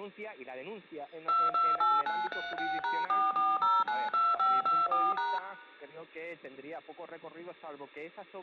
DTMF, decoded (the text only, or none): 228936#44092524#